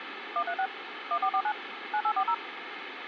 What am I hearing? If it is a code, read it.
DTMF, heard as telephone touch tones, dialled by machine, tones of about 70 ms, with phone line noise. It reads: 136 1449 9840